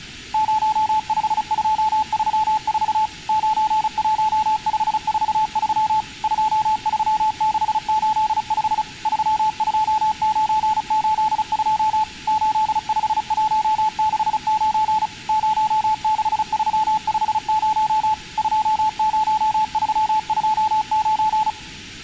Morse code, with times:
0.3-3.1 05234
3.3-6.0 91543
6.2-8.8 23685
9.1-12.0 32982
12.3-15.1 85169
15.3-18.1 06350
18.4-21.5 20329

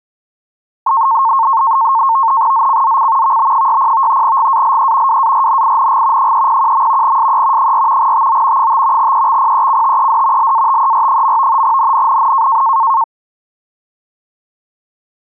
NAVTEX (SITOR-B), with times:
2.5-3.4 ZCZC
3.2-4.2 VB60
4.2-5.2 GALE
5.1-6.3 WARNING
6.2-7.2 301.
7.0-7.7 SE
7.6-8.1 4
8.0-8.7 TO
8.6-9.1 5
9.0-10.5 EXPECTED
10.4-11.6 LATER.
11.6-12.6 NNNN

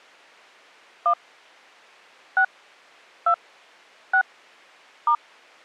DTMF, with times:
1.1-1.1 1
2.4-2.4 6
3.3-3.3 2
4.1-4.2 6
5.1-5.2 *

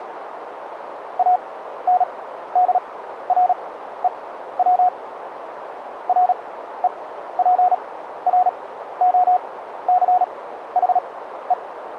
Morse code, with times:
1.2-4.9 ANDREW
6.1-11.5 REPROCHE

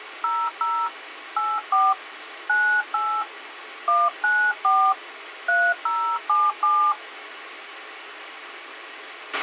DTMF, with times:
0.2-0.9 00
1.4-1.9 84
2.5-3.2 98
3.9-4.9 194
5.5-6.9 3077

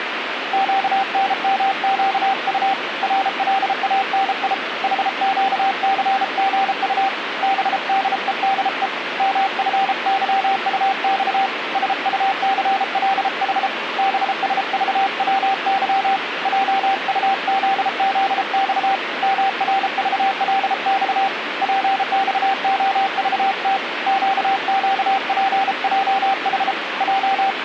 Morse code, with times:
0.5-2.7 QNMQU
3.0-4.5 RLANI
4.8-7.1 HQCGU
7.4-8.9 BDEDE
9.2-11.5 MFYUX
11.8-13.7 SUCLH
14.0-16.2 BSVWY
16.5-19.0 JUZZX
19.2-21.3 MRVLX
21.6-23.8 PXOVT
24.1-26.7 QQPJH
27.0-27.6 …

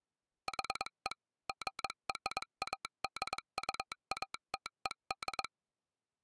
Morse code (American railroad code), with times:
0.5-1.1 HE
1.5-5.4 GRADUATED

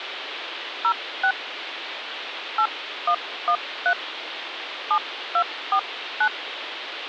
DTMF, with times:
0.8-1.3 06
2.6-3.9 8113
4.9-6.3 7249

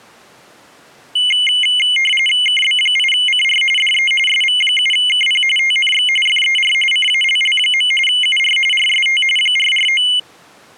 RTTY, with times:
2.5-3.6 KB8CR
3.8-4.1 DE
4.3-5.4 SV7KP
5.6-6.1 TNX
6.3-6.7 FER
6.9-7.9 CALL.
8.1-8.6 UR
8.7-9.2 RST
9.4-10.0 449

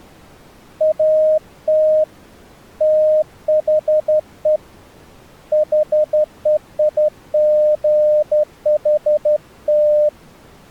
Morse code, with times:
0.8-2.0 AT
2.8-4.6 THE
5.5-10.1 HEIGHT

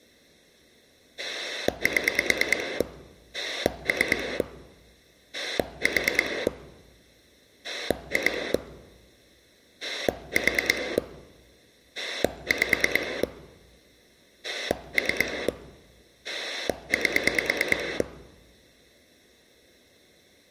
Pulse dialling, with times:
1.2-2.8 7
3.3-4.4 3
5.3-6.5 4
7.6-8.5 2
9.8-11.0 4
12.0-13.2 5
14.4-15.5 3
16.2-18.0 8

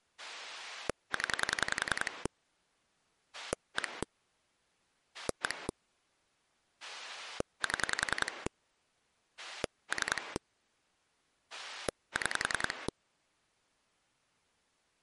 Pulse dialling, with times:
0.2-2.3 0
3.3-4.0 1
5.1-5.7 1
6.8-8.5 7
9.4-10.4 3
11.5-12.9 6

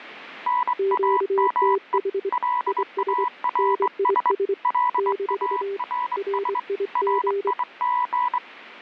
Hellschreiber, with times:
none

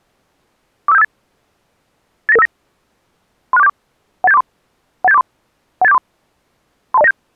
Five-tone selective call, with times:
0.9-1.0 45758
2.3-2.5 89959
3.5-3.7 36474
4.2-4.4 18743
5.0-5.2 18743
5.8-6.0 18743
6.9-7.1 32097

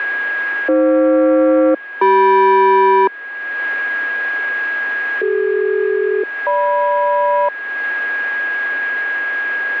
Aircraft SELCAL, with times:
0.7-3.1 AF-CM
5.2-7.5 CD-GM

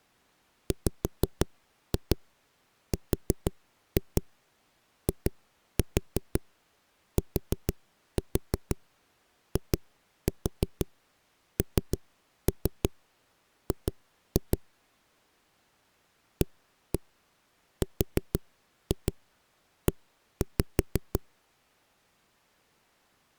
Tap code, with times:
0.7-14.6 WRITING
16.4-21.2 ARE

